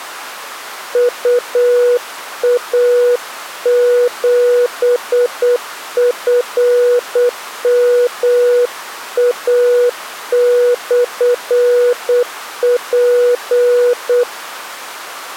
Morse code, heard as a keyed tone, hand-sent with a paddle, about 8 wpm, 490 Hz. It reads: UA7FMA/P